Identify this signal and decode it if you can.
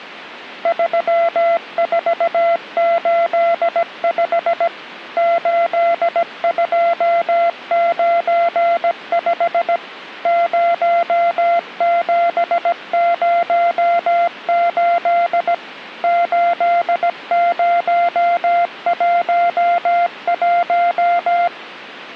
Morse code, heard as a keyed tone, machine-sent, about 17 wpm, 690 Hz. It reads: 3485 8295 0708 8011